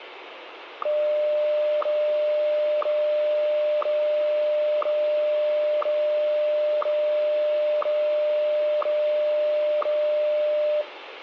Radio time signal (WWVH, Hawaii), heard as ticks, one a second, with radio static and room echo.